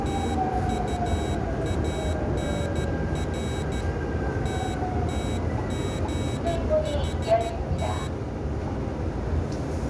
Morse code (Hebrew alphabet), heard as a high beeper, hand-sent with a paddle, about 13 wpm, 3850 Hz, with the noise inside a subway train. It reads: תטאנר תתגחת